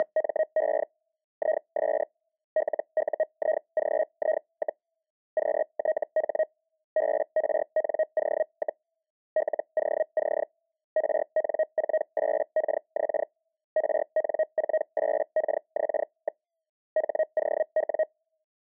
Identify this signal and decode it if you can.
Hellschreiber (Feld-Hell, 122.5 baud), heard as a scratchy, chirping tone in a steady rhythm, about 630 Hz. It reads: … IS LUIGI, QTH BRNO, LOC RN48KX RN48KX. HOW